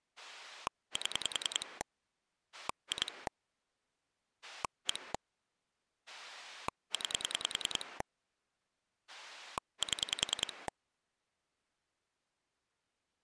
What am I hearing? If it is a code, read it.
Pulse dialling, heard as a rotary dial, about 10 pulses a second. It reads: 7 2 1 9 7